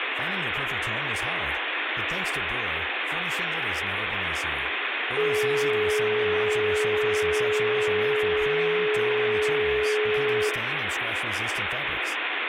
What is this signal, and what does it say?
Telephone call progress tone (425 Hz plan, as in most of Europe), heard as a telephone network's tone, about 420 Hz, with phone line noise, room echo and speech in French. Dial tone.